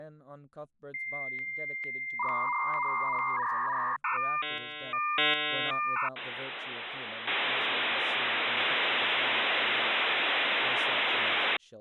Dial-up modem handshake (V.34 or later), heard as a whistle, warbles, then hiss, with speech in English.